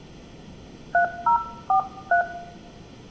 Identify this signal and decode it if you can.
DTMF, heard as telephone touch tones, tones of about 100 ms, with room echo. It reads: 3043